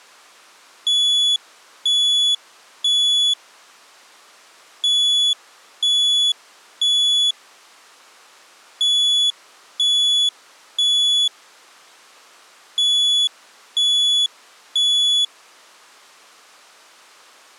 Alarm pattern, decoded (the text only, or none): temporal three